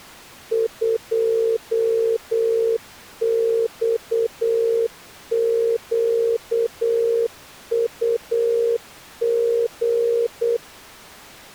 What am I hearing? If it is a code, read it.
Morse code, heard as a keyed tone, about 8 wpm, 460 Hz. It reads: 2XQUG